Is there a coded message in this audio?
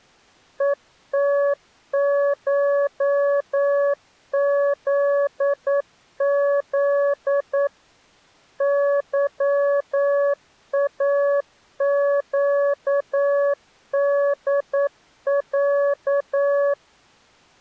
Yes: Morse code (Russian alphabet) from 0.5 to 16.8 s, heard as a keyed tone, machine-sent, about 9 wpm, 570 Hz. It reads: ЕТШЗЗ ЫАЩДЯ